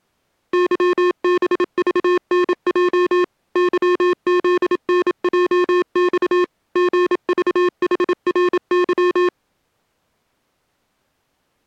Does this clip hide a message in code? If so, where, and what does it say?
Yes: Morse code (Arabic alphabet) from 0.5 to 9.3 s, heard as electronic beeps, machine-sent, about 27 wpm, 360 Hz. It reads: ظبضنج ظذنجص غضحرظ